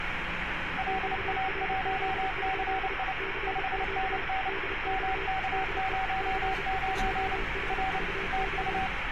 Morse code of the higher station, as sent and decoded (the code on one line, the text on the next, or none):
.-.. .- .---- -.-. .. / ..... -. -. / -- -.- ----- ----. / .-. / - ..-
LA1CI 5NN MK09 R TU